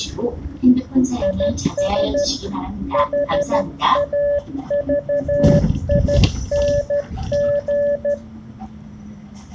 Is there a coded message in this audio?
Yes: Morse code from 1.2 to 8.2 s, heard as a keyed tone, hand-sent with a straight key, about 13 wpm, 580 Hz, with the noise inside a bus. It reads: IS HAVING